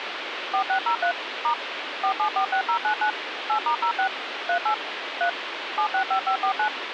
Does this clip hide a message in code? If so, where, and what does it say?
Yes: DTMF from 0.5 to 6.7 s, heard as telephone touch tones, dialled by machine, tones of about 90 ms, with phone line noise. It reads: 4603 * 4746099 8*06 38 3 765549